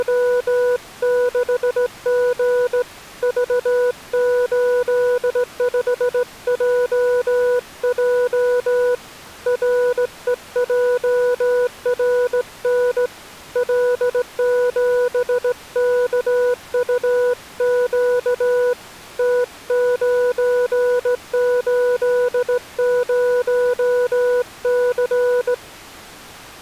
Morse code, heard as a keyed tone, hand-sent with a straight key, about 17 wpm, 490 Hz. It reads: … V85JJ REJRN L7KUQ T980C